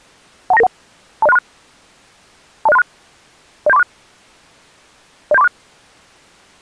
Five-tone selective call (EIA), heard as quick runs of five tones, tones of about 30 ms. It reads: 12991 20636 20636 07346 07346